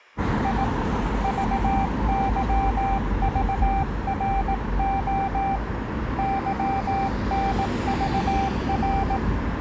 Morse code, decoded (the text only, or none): I VYVRO YNVR